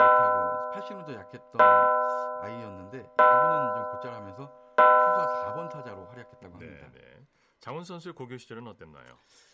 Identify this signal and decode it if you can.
Clock strike, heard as a bell, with speech in Korean. 4. Four o'clock.